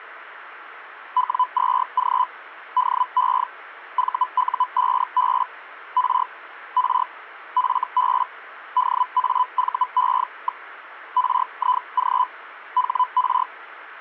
Hellschreiber (Feld-Hell, 122.5 baud), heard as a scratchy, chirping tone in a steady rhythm, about 1000 Hz. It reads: W2G DE VU5B R R FB DAVE. RIG HR